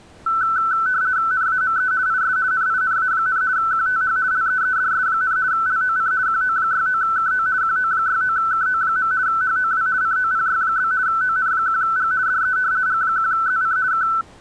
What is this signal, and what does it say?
RTTY (50 baud, 170 Hz shift), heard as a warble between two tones, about 1420 Hz centre. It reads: NAME IS NINA, QTH LEEDS, LOC QO69KO QO69KO. HOW COPY? ON1G DE G1ZC K